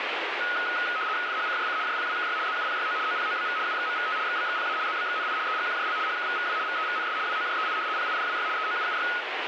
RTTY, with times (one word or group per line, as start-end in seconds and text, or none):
1.3-1.8 FHCJC
1.9-2.4 JPWKY
2.5-3.0 ZUPYO
3.1-3.6 OPOBV
3.7-4.2 UXMVT
4.3-4.8 XBXPA
4.9-5.4 ZBXNI
5.5-6.0 EGQJL
6.1-6.6 HKVVW
6.7-7.2 VEVNS
7.3-7.8 WOJEI
8.0-8.5 PIDWY
8.6-9.1 EOUUY